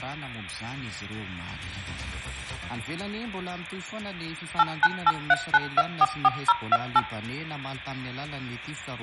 DTMF, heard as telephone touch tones, dialled by machine, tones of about 40 ms, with hum and room echo. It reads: 89839244028